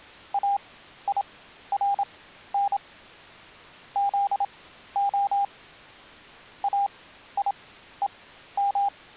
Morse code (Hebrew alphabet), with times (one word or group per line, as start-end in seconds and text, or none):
0.3-2.8 אירן
4.0-5.4 זה
6.6-8.9 איום